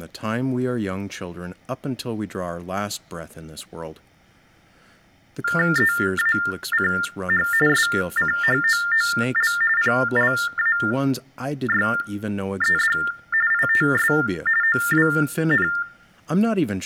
TTY/TDD text telephone tones (45.45 baud Baudot), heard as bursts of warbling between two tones, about 400 Hz shift, 1600 Hz centre, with room echo and speech in English. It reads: EACH SCHOOL PLAYED ITS OWN